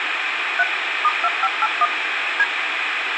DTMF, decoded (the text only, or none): 3 *2581 D